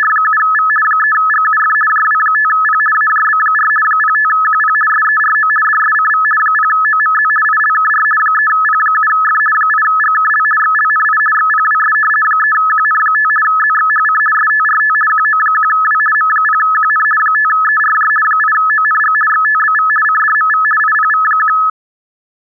RTTY (50 baud, 450 Hz shift), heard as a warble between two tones, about 1500 Hz centre. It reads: … 3GUF JW5P AJB4 05QP SERO DSCV 0OMZ ILKR 3P7F 8GKL XLNI XPWS 3QN5 ZXHC STRT QO1W M0QN 5ERJ 8ONG XTBV CDMV IPV1